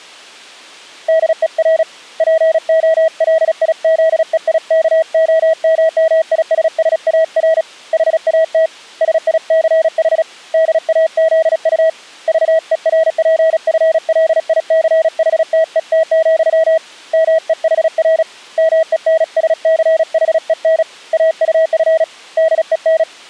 Morse code, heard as a keyed tone, hand-sent with a paddle, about 36 wpm, 640 Hz. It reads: DER POLIZEIKOMMISSAR HAT SICH DAZU VERPFLICHTET, MEHR MENSCHEN AUF DEN